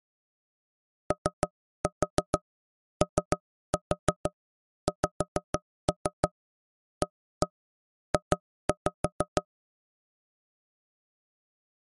Tap code, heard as knocks on wood, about 6 knocks a second. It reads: OOXAJ